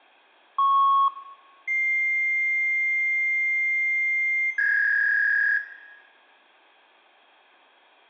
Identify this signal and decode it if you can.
Fax machine handshake, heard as a beep, a long tone and a warble, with room echo.